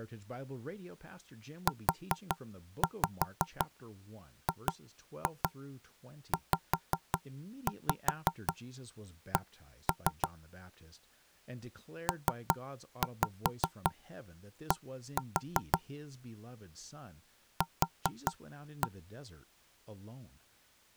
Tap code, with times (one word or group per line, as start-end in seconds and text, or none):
1.7-10.3 UGZC
12.1-15.8 PD
17.6-18.9 Q